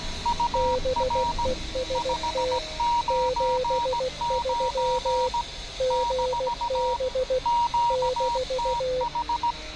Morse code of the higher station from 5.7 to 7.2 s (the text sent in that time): -